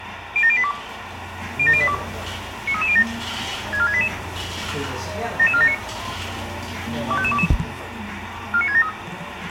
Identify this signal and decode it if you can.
Five-tone selective call (ZVEI), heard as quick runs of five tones, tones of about 70 ms, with radio hiss and the noise of a cafe. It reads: 07082 07082 93307 64688 77479 25522 49673